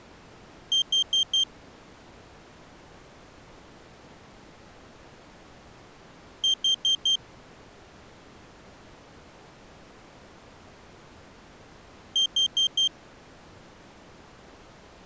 Alarm pattern, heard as an alarm's beeps, played three times, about 3150 Hz. Temporal four. Carbon monoxide.